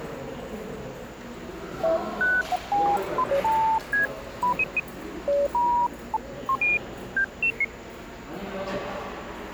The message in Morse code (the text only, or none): none